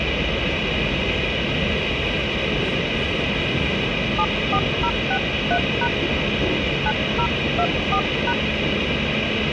DTMF, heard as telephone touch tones, dialled by hand, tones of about 70 ms, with radio hiss and the noise inside a subway train. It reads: 74063# 9024#